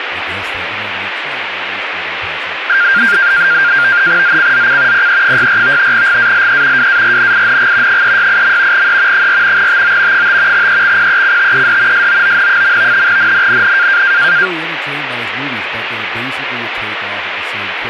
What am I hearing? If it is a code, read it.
NAVTEX (SITOR-B), 100 baud, 170 Hz shift, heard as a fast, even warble, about 1500 Hz centre, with radio static and speech in English. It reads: ZCZC PE64 GALE WARNING 368. E 4 TO 5 EXPECTED SOON. NNNN